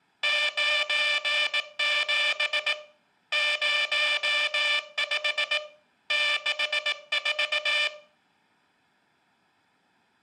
Morse code, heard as a buzzer, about 18 wpm. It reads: 97 05 64